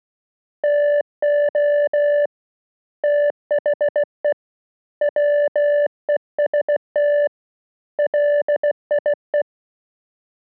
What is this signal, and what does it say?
Morse code, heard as a keyed tone, hand-sent with a bug key, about 16 wpm, 580 Hz. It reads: TO THE WEST LIE